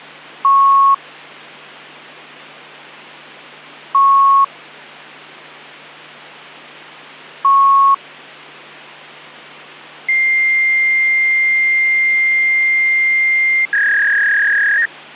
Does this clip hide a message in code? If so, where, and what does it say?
Yes: fax machine handshake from 0.4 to 14.9 s, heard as beeps, a long tone and a warble.